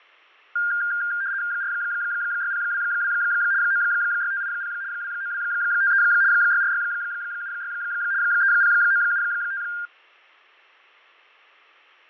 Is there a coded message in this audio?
Yes: RTTY (75 baud, 170 Hz shift) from 0.6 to 9.9 s, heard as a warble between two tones, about 1500 Hz centre, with fading. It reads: 46022 96580 29253 64676 30975